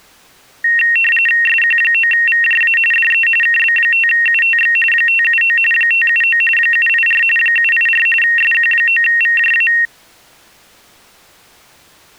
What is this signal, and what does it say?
RTTY (45.45 baud, 850 Hz shift), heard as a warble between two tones, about 2300 Hz centre. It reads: SQ9VJA DE KB5UTX 579 579 784 784 SQ9VJA